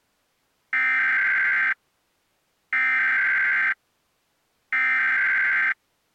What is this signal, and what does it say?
Emergency Alert System (SAME) tones (header bursts), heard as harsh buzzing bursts, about 520.83 baud.